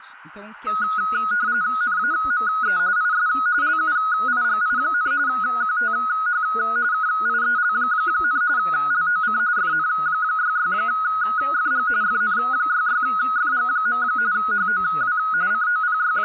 RTTY (45.45 baud, 170 Hz shift), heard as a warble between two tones, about 1360 Hz centre, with speech in Portuguese. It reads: NAME IS LUIGI, QTH KIEL, LOC FN66FG FN66FG. HOW …